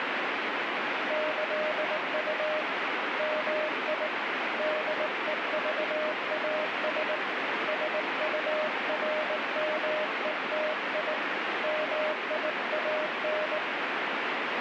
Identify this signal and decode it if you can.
Morse code (with Esperanto letters), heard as a keyed tone, hand-sent with a paddle, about 19 wpm, 620 Hz, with heavy radio static. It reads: ĈU MI DEVAS SURMETI MIAN